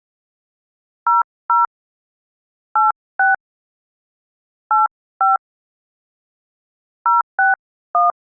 DTMF, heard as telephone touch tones, dialled by hand, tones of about 150 ms. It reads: 00 86 85 061